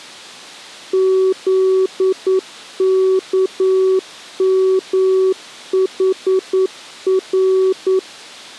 Morse code, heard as a keyed tone, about 9 wpm, 380 Hz. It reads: ZKMHR